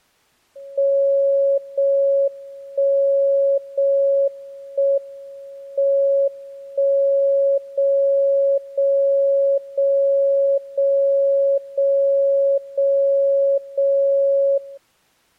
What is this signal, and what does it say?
Radio time signal (JJY), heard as a tone whose level steps once a second, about 550 Hz. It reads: 0 1 0 1 M 1 0 0 0 0 0 0 0 0